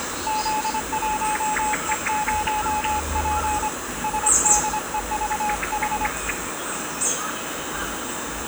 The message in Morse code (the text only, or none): Z1E0P SDEVH